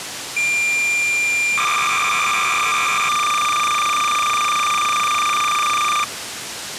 Cassette data (Kansas City type), 300 baud, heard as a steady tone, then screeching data, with tape hiss.